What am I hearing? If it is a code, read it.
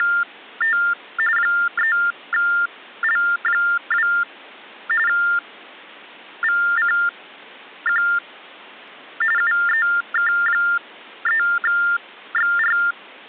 TTY/TDD text telephone tones (45.45 baud Baudot), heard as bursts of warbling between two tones, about 400 Hz shift, 1600 Hz centre. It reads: … 3L2 VCQ UEK3XR